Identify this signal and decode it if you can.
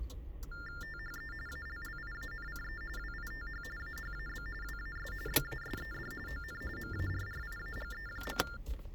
TTY/TDD text telephone tones (45.45 baud Baudot), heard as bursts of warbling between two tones, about 400 Hz shift, 1600 Hz centre, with the noise inside a car. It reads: THE ALLIANCE WITH AHAB WAS BASED ON MARRIAGE.